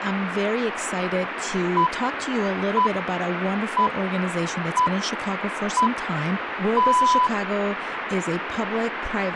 Radio time signal (six pips, as the Greenwich Time Signal), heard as pips, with radio static and speech in English.